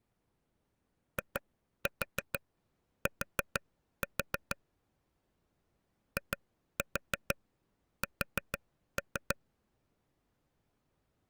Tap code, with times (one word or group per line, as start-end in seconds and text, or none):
1.2-4.6 IT
6.2-9.4 IS